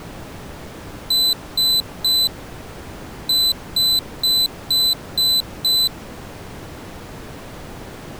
Beep code, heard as a piezo beeper, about 4000 Hz. 3-6.